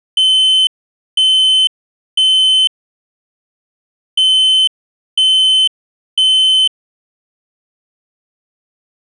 Alarm pattern, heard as an alarm's beeps, played twice, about 3050 Hz. Temporal three. Smoke or fire, evacuate.